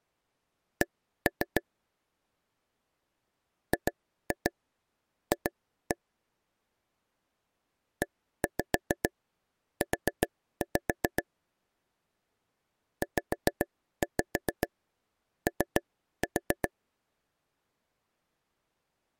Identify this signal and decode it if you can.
Tap code, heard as taps on a table, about 7 knocks a second. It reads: C GF EU ZO